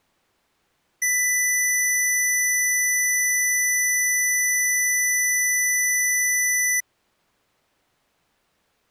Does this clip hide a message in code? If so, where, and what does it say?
No, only a steady tone.